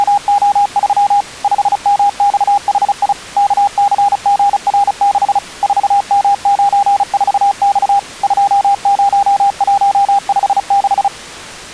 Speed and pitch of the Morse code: 35 wpm, 810 Hz

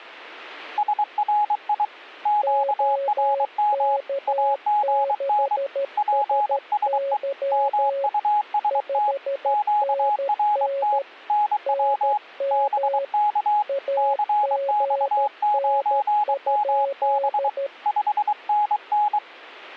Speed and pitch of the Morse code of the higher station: 23 wpm, 840 Hz

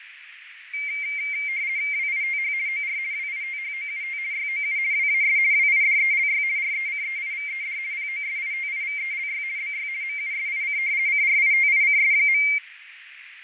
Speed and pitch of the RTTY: 50 baud, 170 Hz shift, 2200 Hz centre

